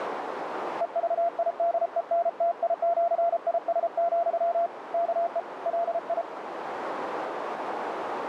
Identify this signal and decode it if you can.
Morse code (with Esperanto letters), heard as a keyed tone, hand-sent with a paddle, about 33 wpm, 680 Hz, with radio static and a narrow filter. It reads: EVIDENTIĜIS, KE LI